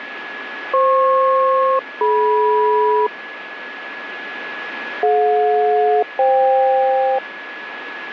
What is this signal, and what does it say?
Aircraft SELCAL, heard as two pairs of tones, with radio static and a steady whistle near 1690 Hz. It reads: FP-DM DJ-FK